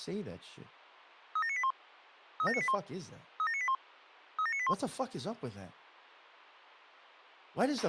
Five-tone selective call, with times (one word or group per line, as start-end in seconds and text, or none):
1.4-1.7 37981
2.4-2.7 37981
3.4-3.7 37981
4.4-4.7 37981